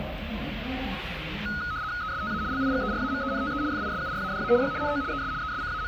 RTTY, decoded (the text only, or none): ESTA LIGERAMENTE FISURADA Y NO ES …